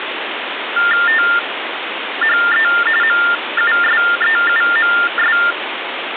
TTY/TDD text telephone tones (45.45 baud Baudot), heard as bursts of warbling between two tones, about 400 Hz shift, 1600 Hz centre, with phone line noise. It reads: THE MUSEUMS